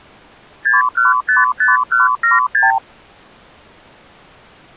Multi-frequency trunk signalling (R2, with the far end's replies), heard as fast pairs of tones, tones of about 160 ms. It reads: 6155176